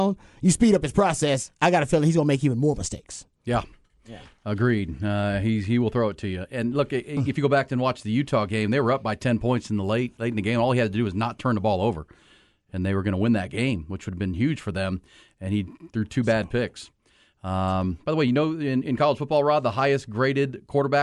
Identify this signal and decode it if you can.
Speech in English. There is no code.